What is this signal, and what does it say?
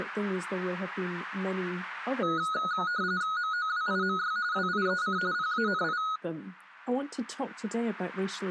RTTY (45.45 baud, 170 Hz shift), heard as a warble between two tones, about 1360 Hz centre. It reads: MOWIMY WIEC PANI